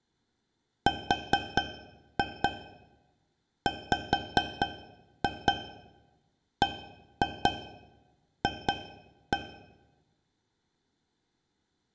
Tap code, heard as taps on a metal pipe, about 4 knocks a second, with room echo. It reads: RWBF